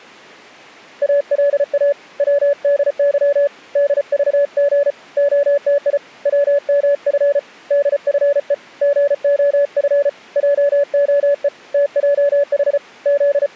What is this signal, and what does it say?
Morse code, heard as a keyed tone, hand-sent with a paddle, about 34 wpm, 570 Hz. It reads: ALA WDY DVG OTI WMF DFE GOF JOE TJH …